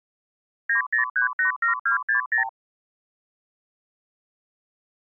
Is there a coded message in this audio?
Yes: multi-frequency trunk signalling (R2, with the far end's replies) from 0.7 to 2.5 s, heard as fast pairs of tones, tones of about 120 ms. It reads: 90387260